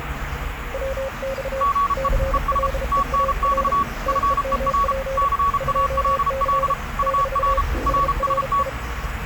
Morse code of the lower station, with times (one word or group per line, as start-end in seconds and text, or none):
0.7-1.6 WX
2.0-3.7 CLEAR
4.1-5.2 TEMP
5.6-6.7 2C
7.0-7.6 -
7.9-8.7 SRI